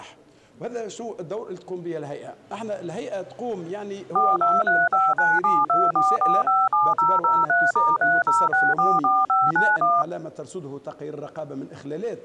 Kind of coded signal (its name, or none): DTMF